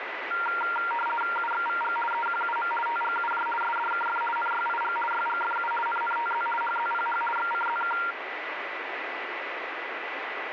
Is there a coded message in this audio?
Yes: RTTY (50 baud, 450 Hz shift) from 0.3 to 8.1 s, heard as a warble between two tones, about 1160 Hz centre, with radio static and a steady whistle near 1990 Hz. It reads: UXVG EQUM TGUJ SDKF NYIG YGFU NNTZ HZPH XCZK